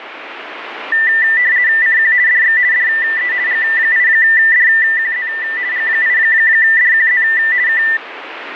RTTY (50 baud, 170 Hz shift), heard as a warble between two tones, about 1900 Hz centre, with radio static. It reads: CQ DX DE G8DQZ G8DQZ K